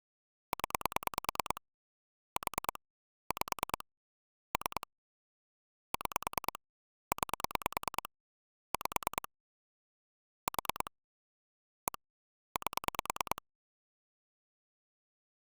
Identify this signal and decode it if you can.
Pulse dialling, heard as clicks on a phone line, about 9 pulses a second. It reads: 0 4 5 3 6 9 5 4 1 8